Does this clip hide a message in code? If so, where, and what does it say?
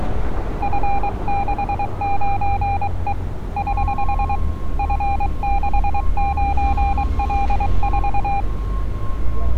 Yes: Morse code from 0.6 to 8.5 s, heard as a keyed tone, hand-sent with a paddle, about 23 wpm, 800 Hz, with street noise. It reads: F69E <HH> F69L4